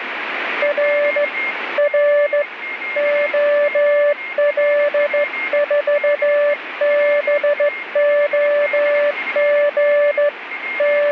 Morse code, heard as a keyed tone, hand-sent with a straight key, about 14 wpm, 580 Hz, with radio static and a weaker station near 2130 Hz. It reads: R R OL4BOG …